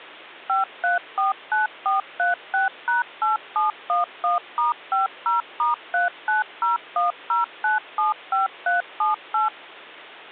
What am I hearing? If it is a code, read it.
DTMF, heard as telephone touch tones, dialled by machine, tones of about 140 ms, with hum. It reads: 5349436#8711*50*39010975378